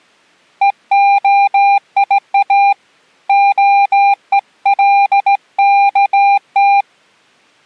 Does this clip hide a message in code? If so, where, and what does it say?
Yes: Morse code (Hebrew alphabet) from 0.6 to 6.9 s, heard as a keyed tone, hand-sent with a straight key, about 17 wpm, 800 Hz. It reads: והיא הולכת